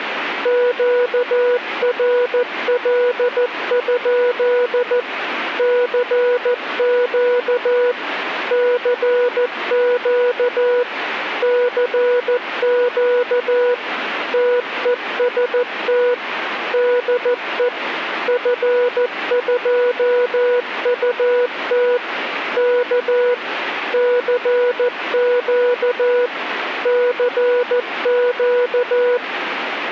Morse code, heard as a keyed tone, machine-sent, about 14 wpm, 490 Hz, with radio static. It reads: QRL? CQ CQ CQ TEST DE F2UT K CQ CQ